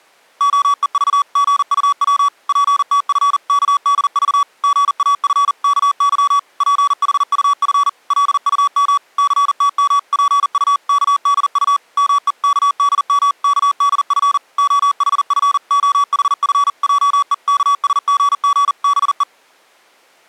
Morse code (Korean alphabet), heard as electronic beeps, machine-sent, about 40 wpm, 1140 Hz. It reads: 팔십 전을 손에 쥔 김 첨지의 마음은 푼푼하였다